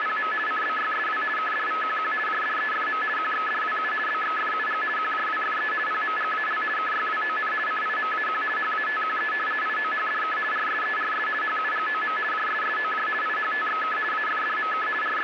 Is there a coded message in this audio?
Yes: RTTY (50 baud, 450 Hz shift) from 0.0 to 15.2 s, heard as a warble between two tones, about 1500 Hz centre, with radio static. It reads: … CBYSW KDVQQ JDEFM QXDWU BXFUG QJWFE PMGAL KYWON CIMAQ HATQE IOHDK RSERS HUGOM JSSOJ IHTXK AFDMK …